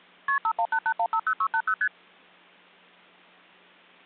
Multi-frequency trunk signalling (R1, as on North American trunks), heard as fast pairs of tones, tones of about 70 ms. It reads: KP 5188150680 ST